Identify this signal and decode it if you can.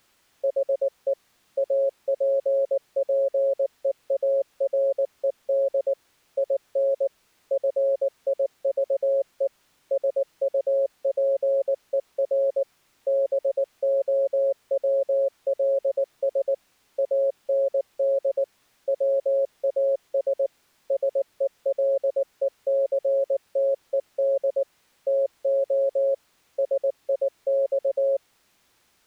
Morse code, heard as a keyed tone, machine-sent, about 19 wpm, 550 Hz. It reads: HE APPEARED IN FIVE SUPER BOWLS AND WAS SELECTED TO SIX